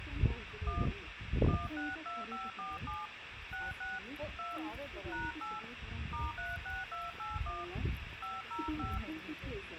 DTMF, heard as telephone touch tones, dialled by hand, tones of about 190 ms, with phone line noise and the noise of a park. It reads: 1 162547 66 2 #8 *36281 505